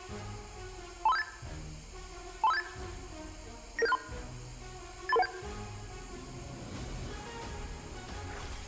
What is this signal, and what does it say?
Five-tone selective call (EIA), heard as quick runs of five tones, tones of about 30 ms. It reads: 23578 23578 99763 83317